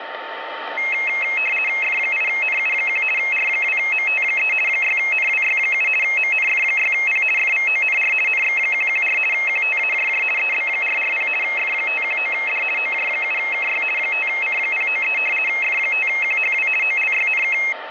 RTTY (50 baud, 450 Hz shift), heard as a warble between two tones, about 2350 Hz centre, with radio static and a steady whistle near 900 Hz. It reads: F8NU1 R2MT3 6NWY7 MNF6P FVONR NX114 QTAJJ EB440 F519D OJ7KY 5C093 F5QHW OLYNK